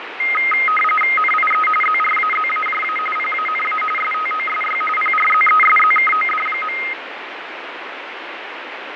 RTTY (45.45 baud, 850 Hz shift), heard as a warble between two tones, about 1700 Hz centre, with radio static and fading. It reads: NIE ZRAZAJA PANA STOSY PRZESZKOD.